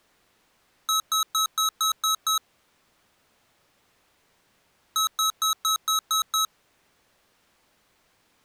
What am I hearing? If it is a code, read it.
Beep code, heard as beeps from a small speaker, played twice, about 1290 Hz. 7 short. In AMI BIOS tables: virtual mode exception error; in Dell tables: processor failure.